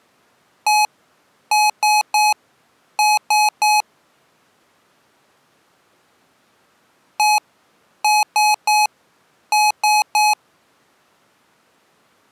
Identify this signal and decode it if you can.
Beep code, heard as beeps from a small speaker, played twice, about 840 Hz. 1-3-3. In Phoenix BIOS tables: chip or data line failure in the first 64 KB of memory.